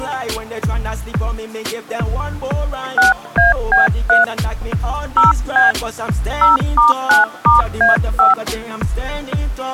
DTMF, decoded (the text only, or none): 6AB3 0B 0*9*A5